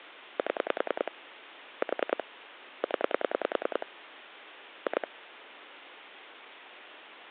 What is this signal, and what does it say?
Pulse dialling, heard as clicks on a phone line, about 10 pulses a second, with phone line noise. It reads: 7 4 0 2